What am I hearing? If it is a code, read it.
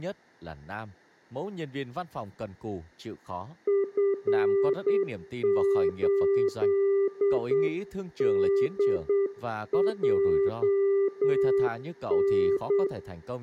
Morse code, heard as a keyed tone, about 8 wpm, 400 Hz, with room echo and speech in Vietnamese. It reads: F8DJN